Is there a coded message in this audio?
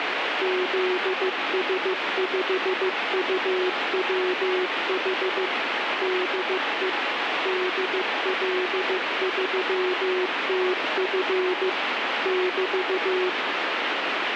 Yes: Morse code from 0.4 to 13.4 s, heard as a keyed tone, machine-sent, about 15 wpm, 370 Hz, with heavy radio static. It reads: ZS5UWH DE DL3TF <BT>